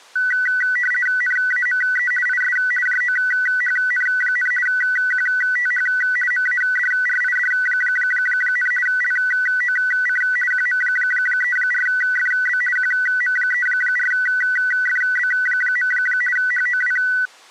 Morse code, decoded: none

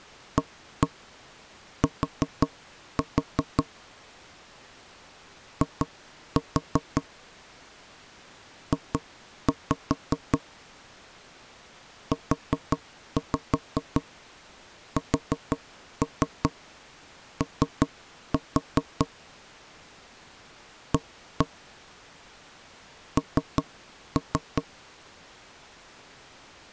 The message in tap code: AT I J USO A N

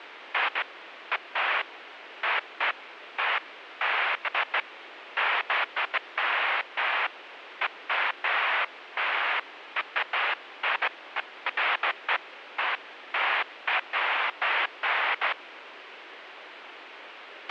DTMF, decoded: none

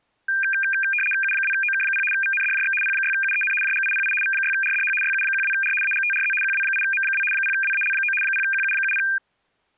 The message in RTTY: U2OK0 VNDJX P6UEN JGIPI V6RDH YU12R AGTRZ QW8M2 0WAL9 0QU70

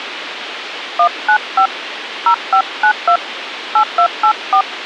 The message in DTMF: 195 0592 8284

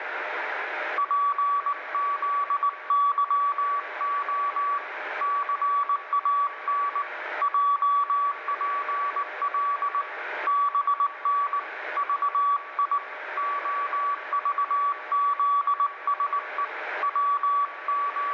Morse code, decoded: PZYO CAN JPL BN VI OVZSE …

